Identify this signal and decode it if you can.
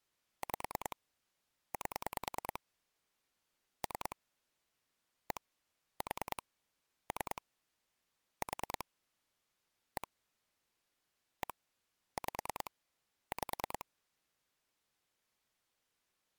Pulse dialling, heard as clicks on a phone line, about 9 pulses a second. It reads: 5 8 3 1 4 3 4 1 1 5 5